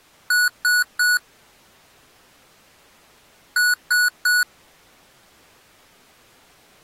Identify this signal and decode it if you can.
Beep code, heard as beeps from a small speaker, played twice, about 1470 Hz. 3 short. In AMI BIOS tables: failure in the first 64 KB of memory; in Dell tables: chipset error.